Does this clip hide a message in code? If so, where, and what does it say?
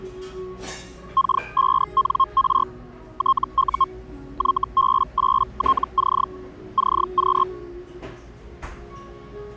Yes: Hellschreiber (Feld-Hell, 122.5 baud) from 1.2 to 7.4 s, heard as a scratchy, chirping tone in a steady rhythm, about 1070 Hz, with the noise of a cafe. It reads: K5NR TU YB8TC CQ